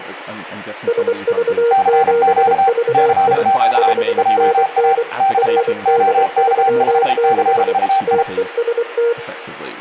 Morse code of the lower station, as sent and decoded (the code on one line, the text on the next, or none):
... ...- --... ...- .. / ..... -. -. / .-. -.. ...-- -.... / - . ... -
SV7VI 5NN RD36 TEST